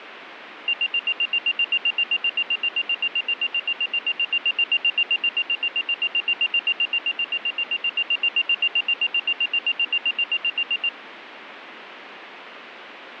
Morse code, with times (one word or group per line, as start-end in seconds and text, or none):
none